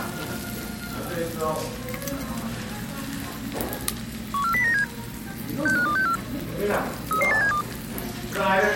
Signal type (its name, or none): five-tone selective call